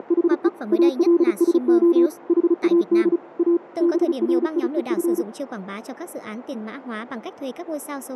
Morse code, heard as a keyed tone, machine-sent, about 35 wpm, 340 Hz, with radio static, a narrow filter and speech in Vietnamese. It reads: … ALSO HAD A BRIEF